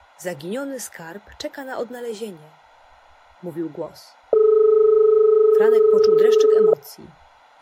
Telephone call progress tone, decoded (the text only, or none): dial tone